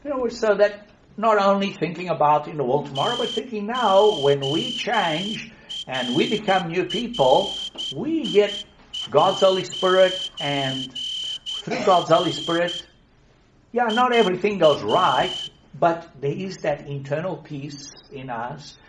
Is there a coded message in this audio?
Yes: Morse code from 2.9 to 15.5 s, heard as a whistle, hand-sent with a straight key, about 10 wpm. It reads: TORRI'R IA